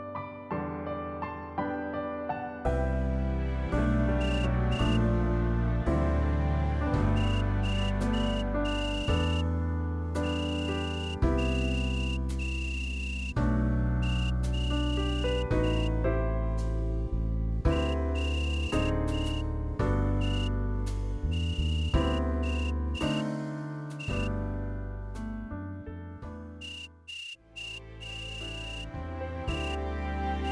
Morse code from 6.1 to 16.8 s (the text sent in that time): VOR